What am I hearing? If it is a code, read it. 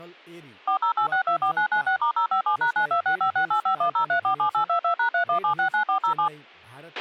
DTMF, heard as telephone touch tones, dialled by machine, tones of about 100 ms, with a squelch burst at the end and speech in Nepali. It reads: 408624996*057#926568510347822#31769407